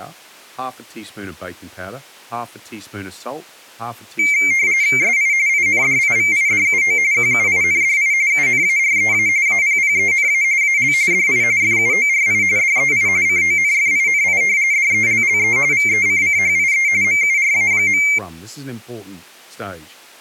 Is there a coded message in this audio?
Yes: RTTY (45.45 baud, 170 Hz shift) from 4.2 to 18.2 s, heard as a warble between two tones, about 2200 Hz centre, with speech in English. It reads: SI INDIVIDUO QUINDI UNAREA APPENA AL DI FUORI DEI CONFINI DELLE VECCHIE MURA.